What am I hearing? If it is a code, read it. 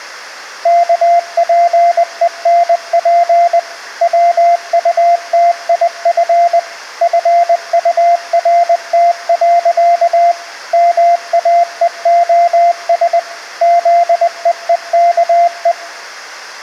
Morse code, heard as a keyed tone, machine-sent, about 20 wpm, 690 Hz. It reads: KPENP WUTIF FURT. MAEOS ZEEKE